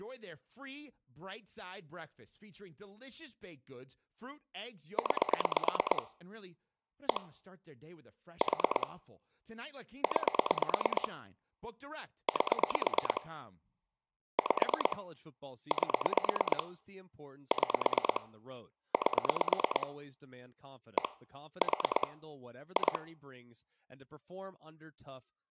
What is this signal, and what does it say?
Pulse dialling, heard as clicks on a phone line, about 9 pulses a second, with speech in English. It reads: 9 1 4 9 8 5 8 6 8 1 4 2